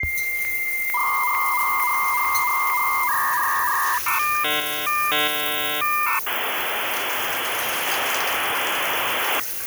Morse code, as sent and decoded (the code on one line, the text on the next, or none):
none